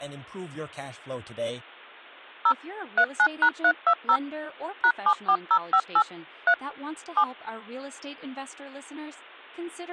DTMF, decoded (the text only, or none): 0 39#320 #74058 3 7